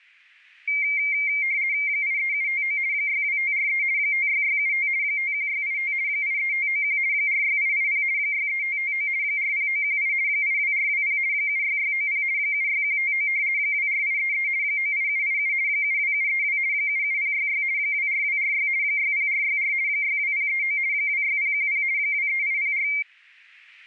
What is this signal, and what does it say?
RTTY (50 baud, 170 Hz shift), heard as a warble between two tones, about 2200 Hz centre. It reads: 83759 62543 56675 51685 83591 46880 63559 40918 82420 76690 76159 24833 98787 72732 77066 24246 60464 62039 26010 23804